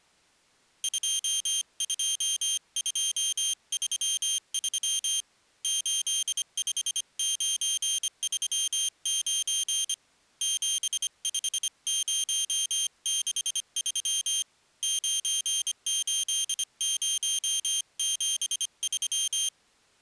Morse code, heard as a high beeper, hand-sent with a paddle, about 25 wpm, 3150 Hz. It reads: 22233 85939 75063 98073